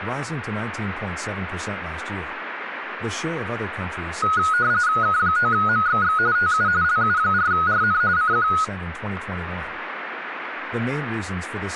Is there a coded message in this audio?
Yes: RTTY (45.45 baud, 170 Hz shift) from 4.2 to 8.6 s, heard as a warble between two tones, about 1360 Hz centre, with radio static and speech in English. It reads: K9MXX TU LU4RN CQ